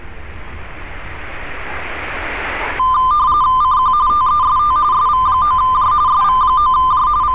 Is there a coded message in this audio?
Yes: RTTY (45.45 baud, 170 Hz shift) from 2.8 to 7.3 s, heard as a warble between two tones, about 1110 Hz centre, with street noise. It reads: CQ TEST SV9J SV9J …